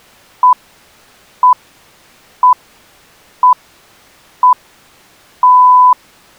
Radio time signal (six pips, as the Greenwich Time Signal), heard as pips.